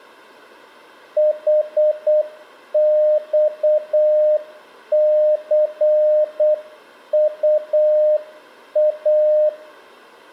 Morse code, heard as a keyed tone, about 8 wpm, 610 Hz, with room echo. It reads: HXCUA